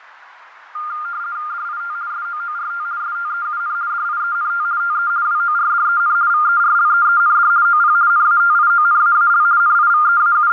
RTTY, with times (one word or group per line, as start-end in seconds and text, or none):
1.5-1.9 DIT
2.1-2.8 SOORT
3.0-3.7 STEUN
3.9-4.6 DIENT
4.8-5.1 TE
5.2-6.1 WORDEN
6.3-7.5 VERLEEND
7.6-7.9 OP
8.1-9.4 NATIONAAL
9.6-10.5 …